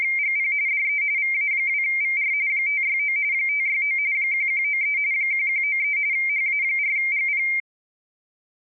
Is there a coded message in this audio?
Yes: RTTY (45.45 baud, 170 Hz shift) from 0.0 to 7.6 s, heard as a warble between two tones, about 2200 Hz centre. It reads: … DE VA2VR 569 569 1193 1193 HA4GP